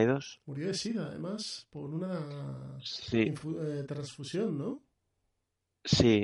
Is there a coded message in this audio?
No.